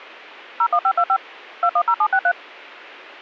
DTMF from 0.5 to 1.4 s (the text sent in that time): 01525